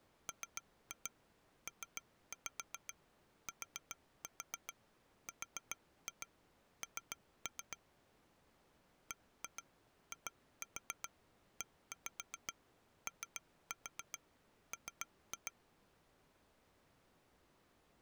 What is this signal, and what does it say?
Tap code, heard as taps on glass, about 7 knocks a second. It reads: MPTRN BIEOM